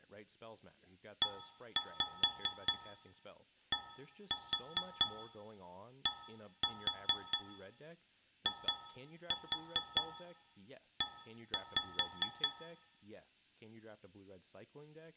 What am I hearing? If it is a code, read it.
Tap code, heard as taps on a metal pipe, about 4 knocks a second, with room echo and speech in English. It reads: EDDIE